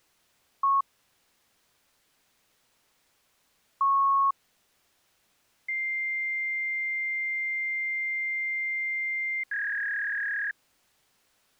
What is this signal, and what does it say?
Fax machine handshake, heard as a beep, a long tone and a warble.